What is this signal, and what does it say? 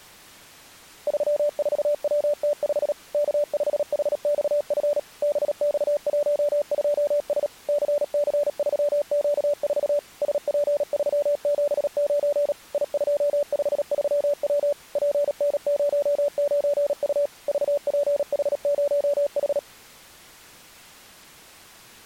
Morse code, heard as a keyed tone, machine-sent, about 37 wpm, 580 Hz. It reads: 34WT5 K5HXF BX12S CC3Q4 SP379 I253W PN09U VPH0H